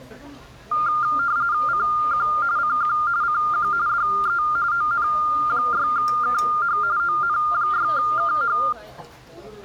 RTTY (45.45 baud, 170 Hz shift), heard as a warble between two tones, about 1300 Hz centre, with the noise of a restaurant. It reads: CQ CQ CQ DE ON6KH ON6KH